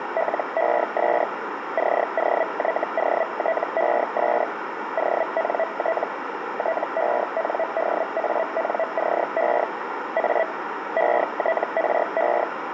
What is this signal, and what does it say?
Hellschreiber (Feld-Hell, 122.5 baud), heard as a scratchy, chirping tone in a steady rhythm, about 650 Hz, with radio static and a narrow filter. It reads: LES COYOTES ONT TENDANCE A ETRE